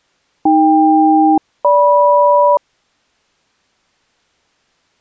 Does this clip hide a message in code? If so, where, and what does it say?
Yes: aircraft SELCAL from 0.5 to 2.6 s, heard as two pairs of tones. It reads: AK-GM